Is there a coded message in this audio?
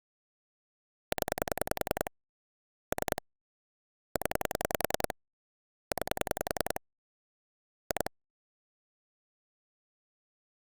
Yes: pulse dialling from 1.1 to 8.1 s, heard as clicks on a phone line, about 10 pulses a second. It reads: 0 3 0 9 2